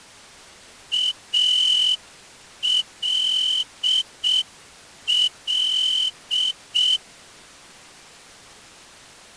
Morse code, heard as a whistle, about 6 wpm. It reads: ALL